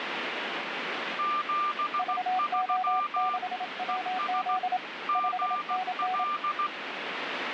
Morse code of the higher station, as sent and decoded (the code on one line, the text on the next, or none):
--... ...-- / . ... / --. .-..
73 ES GL